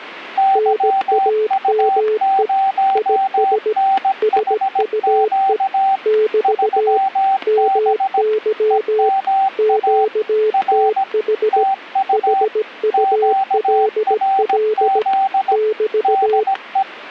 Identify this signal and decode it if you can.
Morse code, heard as two keyed tones, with static crashes. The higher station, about 17 wpm, 780 Hz: YU0NHQ 3B EMA R TU QRZ DE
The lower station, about 17 wpm, 430 Hz: NAME IS SUE <BT> MY QTH HULL <BT>